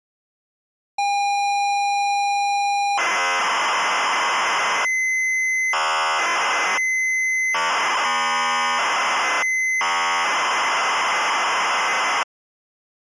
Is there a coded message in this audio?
Yes: ZX Spectrum tape loading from 1.0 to 12.2 s, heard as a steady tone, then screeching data.